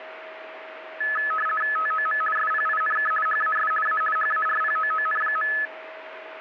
RTTY (50 baud, 450 Hz shift), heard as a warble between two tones, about 1500 Hz centre, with radio static and a steady whistle near 640 Hz. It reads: TOM SPINK HAS A HARPOON.